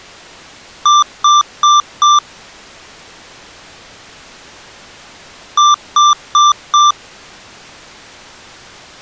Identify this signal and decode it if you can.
Beep code, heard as beeps from a small speaker, played twice, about 1180 Hz. 4 short. In AMI BIOS tables: system timer failure; in Dell tables: memory read or write failure.